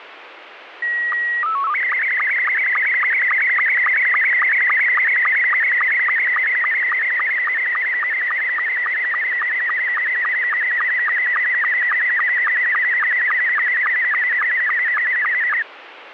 SSTV (slow-scan television), Scottie S2, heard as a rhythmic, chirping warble, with radio static.